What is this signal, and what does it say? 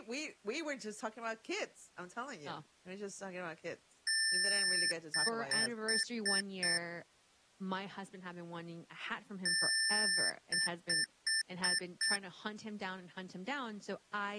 Beep code, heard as beeps from a small speaker, played twice, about 1800 Hz, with speech in English. 1 long, 5 short.